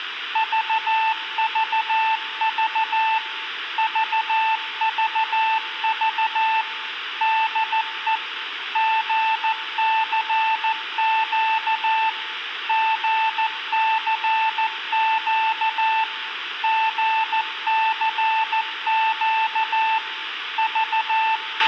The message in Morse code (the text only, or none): VVV VVV DE GCQ GCQ GCQ …